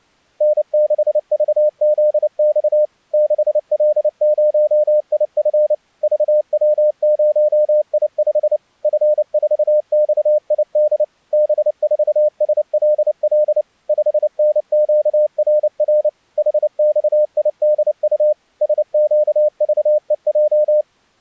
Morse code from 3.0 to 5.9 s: 6L0IF

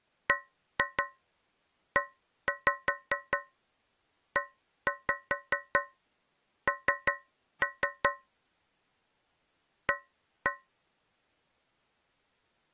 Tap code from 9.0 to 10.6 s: A

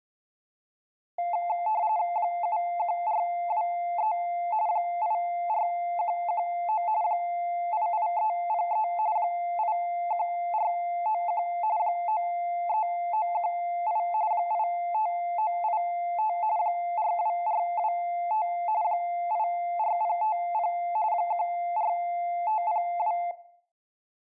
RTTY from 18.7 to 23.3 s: 84050 14502

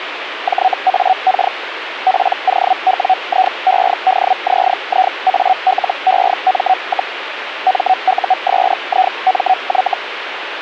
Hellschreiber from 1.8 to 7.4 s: POWIEDZIALEM,

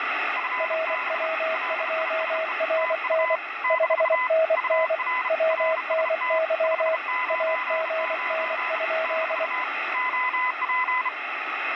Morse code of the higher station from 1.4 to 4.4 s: LISE TU -

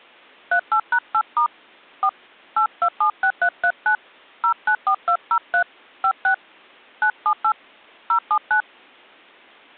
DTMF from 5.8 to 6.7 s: 56

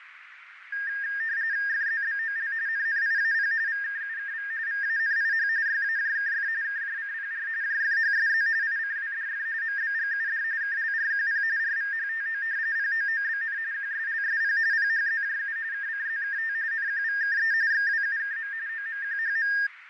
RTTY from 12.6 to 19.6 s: POOBN QSLSP PHZJU KCZKT NQVKE XWUKM OMQHM

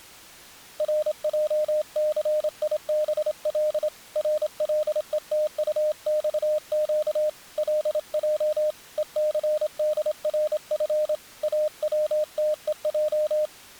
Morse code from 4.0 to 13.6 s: RLETUXQ LJ ECDRF AWTEJ

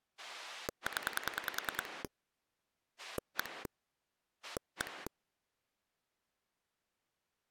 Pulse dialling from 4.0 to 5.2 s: 1

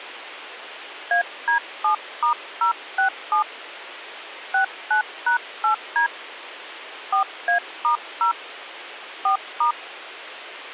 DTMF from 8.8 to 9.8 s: 4*

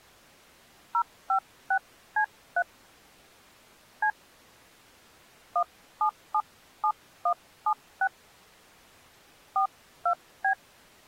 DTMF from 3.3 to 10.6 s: C 1777176 42B

